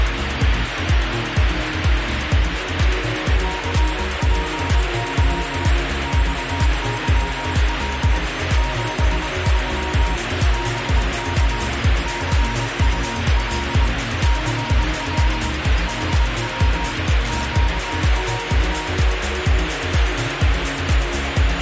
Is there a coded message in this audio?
Yes: Morse code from 3.4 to 18.9 s, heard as a keyed tone, machine-sent, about 22 wpm, 940 Hz, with heavy radio static. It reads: CPY XYL 73 BK CUL CL HW QRT